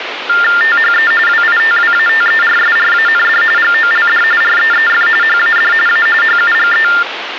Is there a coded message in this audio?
Yes: TTY/TDD text telephone tones (45.45 baud Baudot) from 0.3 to 7.0 s, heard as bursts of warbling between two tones, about 400 Hz shift, 1600 Hz centre, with phone line noise. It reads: THE WITWATERSRAND GOLD REEF HAD A HUGE